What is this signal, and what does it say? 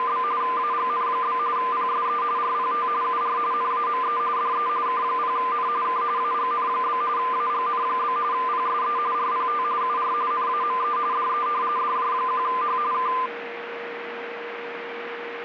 RTTY (45.45 baud, 170 Hz shift), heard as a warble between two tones, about 1110 Hz centre, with radio static and a steady whistle near 470 Hz. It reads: … AGN? PSE RPT UR NAME DE K0N K AGN? AGN? PSE RPT UR NAME DE DJ1H K